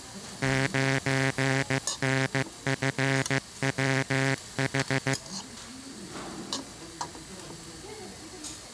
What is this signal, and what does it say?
Morse code, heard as a buzzer, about 15 wpm, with the noise of a restaurant. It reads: 9NFWH